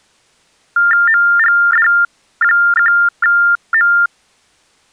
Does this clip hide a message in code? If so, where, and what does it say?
Yes: TTY/TDD text telephone tones (45.45 baud Baudot) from 0.8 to 4.1 s, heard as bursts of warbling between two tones, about 400 Hz shift, 1600 Hz centre. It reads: MGD1M